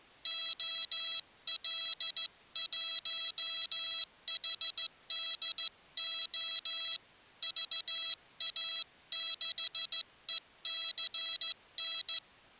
Morse code, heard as a high beeper, hand-sent with a straight key, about 15 wpm, 3950 Hz. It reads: OL1HDO VA6ECN